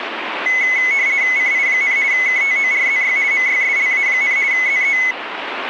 RTTY (50 baud, 170 Hz shift), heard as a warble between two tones, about 2100 Hz centre, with radio static. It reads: CI, KTORZY MYSLA, ZE